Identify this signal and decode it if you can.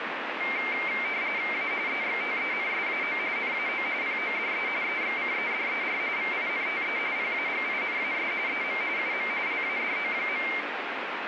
RTTY (45.45 baud, 170 Hz shift), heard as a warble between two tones, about 2200 Hz centre, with radio static. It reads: A EXTENSAO NAO PODE EXCEDER VINTE PAGINAS EM UM LADO.